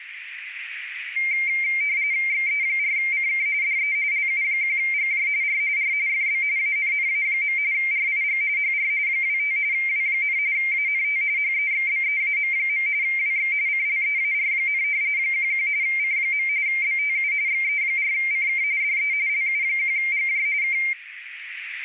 RTTY (45.45 baud, 170 Hz shift), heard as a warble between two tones, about 2200 Hz centre, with radio static and a narrow filter. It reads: XE4CK DE LU1GJ R R FB ANNA. RIG HR 25 W, ANT HEXBEAM. WX CLEAR, 11 C. BTU XE4CK DE LU1GJ K